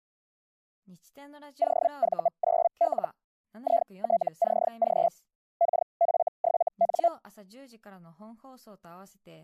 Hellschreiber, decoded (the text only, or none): OV9L ITCG KF7N